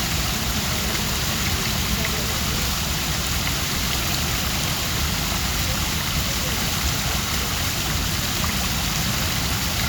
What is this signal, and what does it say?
The noise of a park. There is no code.